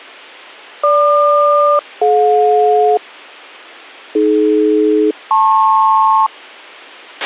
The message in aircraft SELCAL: GQ-DJ AD-LP

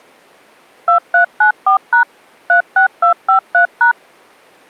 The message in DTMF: 2394# 36253#

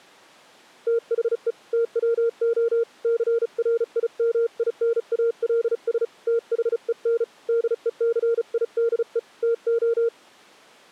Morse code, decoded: THE TWO CRIMINALS THEN DECIDE TO

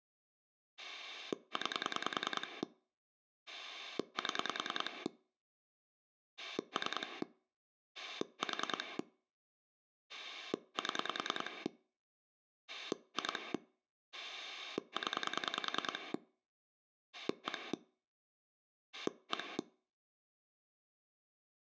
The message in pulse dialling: 9 7 3 4 7 2 0 1 1

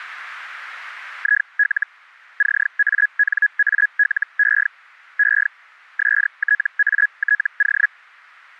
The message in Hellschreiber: IL CANALE E STATO

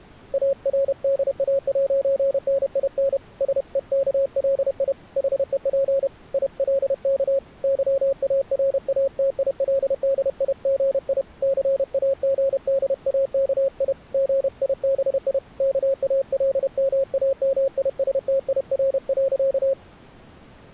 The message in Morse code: ARDA'NIN SEKLI HEP ILK YARATILDIGI CAGDAKI GIBI KALMAMISTIR.

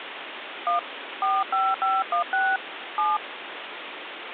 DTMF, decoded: 1 45516 7

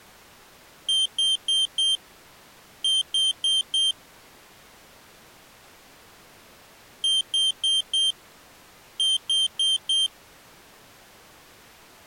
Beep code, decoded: 4-4

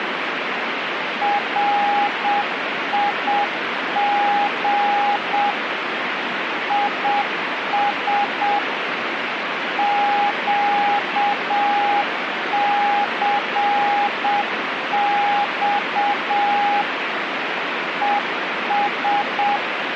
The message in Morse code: RIG IS QCX ES

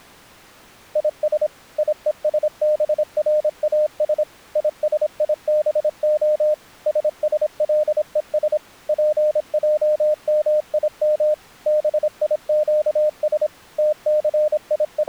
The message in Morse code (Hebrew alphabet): יש יושבראש ישיבה ששלוש פעמים ביקש …

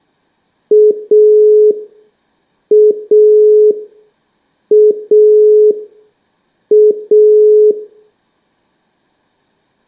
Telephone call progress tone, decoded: dial tone

